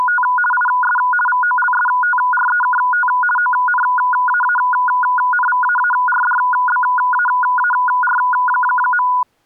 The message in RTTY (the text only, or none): … IS VOLSTREKT ONAANVAARDBAAR.